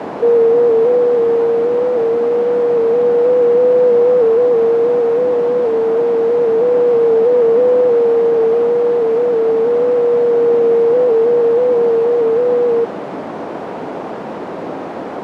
FT8 (one signal), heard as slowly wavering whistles, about 6.25 baud, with radio static and a narrow filter.